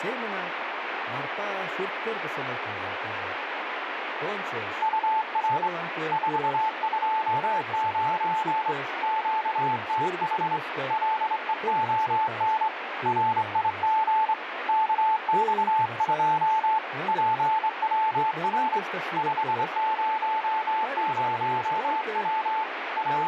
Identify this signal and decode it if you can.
Morse code, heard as a keyed tone, hand-sent with a straight key, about 24 wpm, 880 Hz, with radio static and speech in Russian. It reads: UR 429 QTH LEON RIG KX2 PWR 500W …